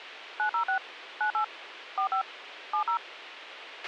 DTMF, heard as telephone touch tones, dialled by machine, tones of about 100 ms, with radio hiss and a squelch burst at the end. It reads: 906 98 45 70